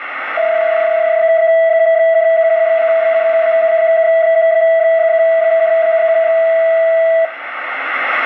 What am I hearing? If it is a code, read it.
PSK31 (31.25 baud), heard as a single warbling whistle, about 660 Hz, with radio static.